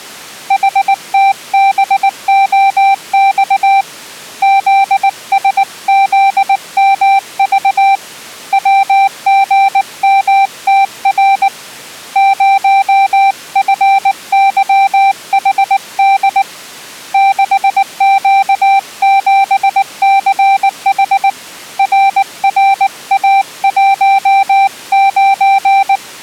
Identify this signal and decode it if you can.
Morse code, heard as a keyed tone, hand-sent with a paddle, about 19 wpm, 780 Hz. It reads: HTBOX ZSZMV WGMTR 0FYHD 6Q7CH RRA19